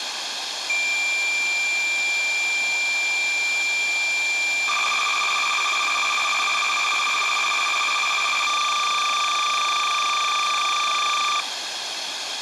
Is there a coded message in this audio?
Yes: cassette data (Kansas City type), 300 baud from 0.7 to 11.4 s, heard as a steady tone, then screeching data, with tape hiss.